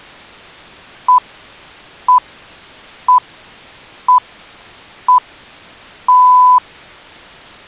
Radio time signal (six pips, as the Greenwich Time Signal), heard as pips.